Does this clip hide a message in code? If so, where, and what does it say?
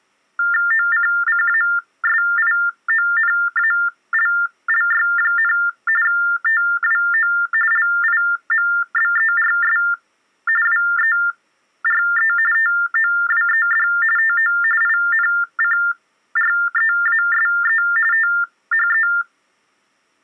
Yes: TTY/TDD text telephone tones (45.45 baud Baudot) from 0.4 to 19.2 s, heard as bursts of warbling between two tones, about 400 Hz shift, 1600 Hz centre. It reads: OCCASIONALLY, TWO LIMBERS WERE TOWED TO INCREASE THE